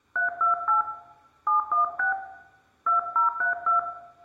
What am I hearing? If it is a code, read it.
DTMF, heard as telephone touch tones, dialled by hand, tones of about 130 ms, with room echo. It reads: 328 716 2032